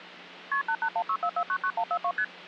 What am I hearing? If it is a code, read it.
Multi-frequency trunk signalling (R1, as on North American trunks), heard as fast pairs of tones, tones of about 70 ms. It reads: KP 88164499142 ST